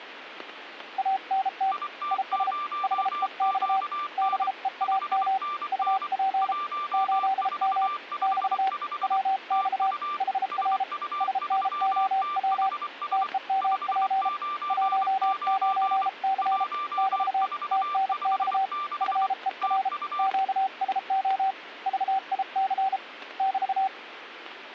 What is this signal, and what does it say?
Morse code, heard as two keyed tones, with radio static and static crashes. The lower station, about 33 wpm, 770 Hz: ANT IS HEX BEAM UP 8M <BT> WX HR SNOW TEMP 19C <BT> TNX FER QSO VIC <BT>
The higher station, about 24 wpm, 1180 Hz: IT0QN 5NN 1455 TU SU3THS 599 1456 TU